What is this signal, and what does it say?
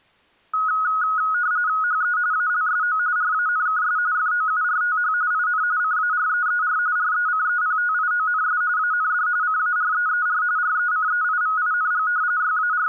RTTY (45.45 baud, 170 Hz shift), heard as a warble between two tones, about 1360 Hz centre. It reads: HE ALSO RANKS FOURTH IN CAREER RECEPTIONS AND CAREER RECEIVING …